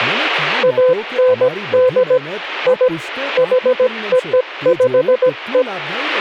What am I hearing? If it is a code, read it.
Morse code (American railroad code), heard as a keyed tone, machine-sent, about 510 Hz, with speech in Gujarati. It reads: AND I HOPE